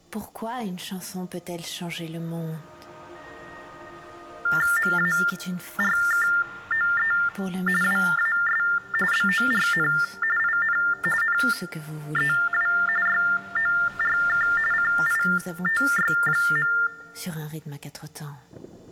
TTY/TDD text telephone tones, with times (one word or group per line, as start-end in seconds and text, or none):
4.8-7.1 MARKOE
7.8-8.6 WAS
9.1-9.9 BORN
10.4-10.8 IN
11.2-12.7 NEW
13.1-14.5 YORK
14.7-16.7 CITY.